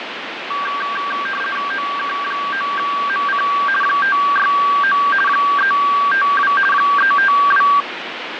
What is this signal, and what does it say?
RTTY (50 baud, 450 Hz shift), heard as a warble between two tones, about 1360 Hz centre, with radio static and fading. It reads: OK9MC 569 352 352